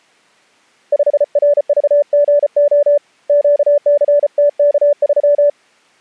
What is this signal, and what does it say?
Morse code, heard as a keyed tone, hand-sent with a paddle, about 34 wpm, 580 Hz. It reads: 5RVGO QCTK3